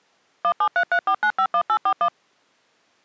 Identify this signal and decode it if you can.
DTMF, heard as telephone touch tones, dialled by machine, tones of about 70 ms. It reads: 17334951841